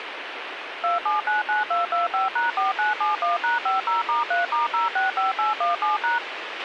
DTMF, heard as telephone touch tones, dialled by machine, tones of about 150 ms, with radio hiss and a squelch burst at the end. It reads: 2799225#4971#50*3*065817#